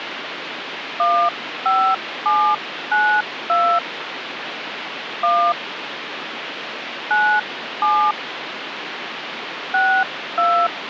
DTMF, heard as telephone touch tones, dialled by hand, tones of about 290 ms, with phone line noise. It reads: 15792 1 97 62